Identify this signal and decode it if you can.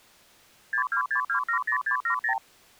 Multi-frequency trunk signalling (R2, with the far end's replies), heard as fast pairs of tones, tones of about 90 ms. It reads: 626270670